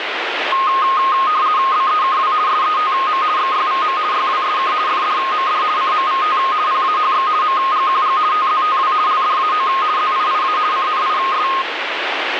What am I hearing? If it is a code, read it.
RTTY (50 baud, 170 Hz shift), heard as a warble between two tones, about 1160 Hz centre, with radio static. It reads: BEKW SETM XYVM YWSK FDMD CMVT PAHX MGQG TZTW LDAO ZIIA CNIS